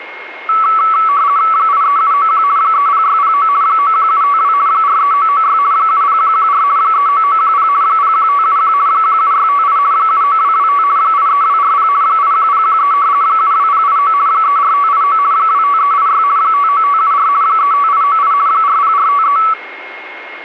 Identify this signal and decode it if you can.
RTTY (50 baud, 170 Hz shift), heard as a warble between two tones, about 1220 Hz centre, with a steady whistle near 2150 Hz. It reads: 83791 30609 91752 43996 70114 39910 01571 17658 79225 83240 81013 72089 34589 25386 59574 35898 40453